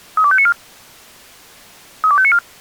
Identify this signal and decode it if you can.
Five-tone selective call (ZVEI), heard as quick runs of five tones, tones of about 70 ms. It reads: 32594 32594